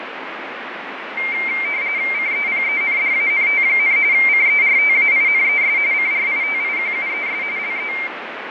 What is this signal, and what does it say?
RTTY (45.45 baud, 170 Hz shift), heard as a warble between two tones, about 2200 Hz centre, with radio static and fading. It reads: CEPENDANT, CERTAINES CRITIQUES LE